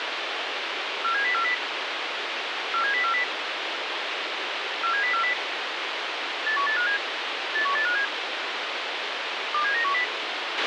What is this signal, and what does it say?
Five-tone selective call (CCIR), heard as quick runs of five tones, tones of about 100 ms, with radio hiss and a squelch burst at the end. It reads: 47040 47040 47040 81857 81857 27910